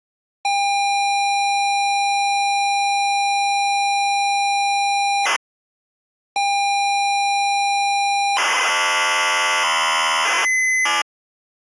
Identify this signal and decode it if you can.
ZX Spectrum tape loading, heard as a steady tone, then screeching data.